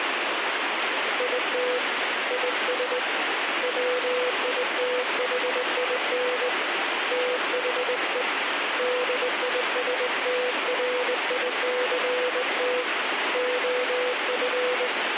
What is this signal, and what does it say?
Morse code, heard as a keyed tone, hand-sent with a straight key, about 20 wpm, 500 Hz, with radio static. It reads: IT IS WITHIN THE DISTRICT OF